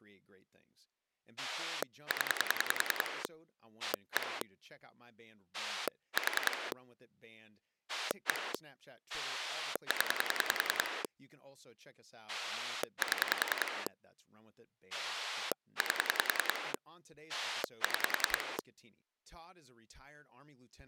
Pulse dialling, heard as a rotary dial, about 10 pulses a second, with speech in English. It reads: 0 1 4 1 0 7 8 6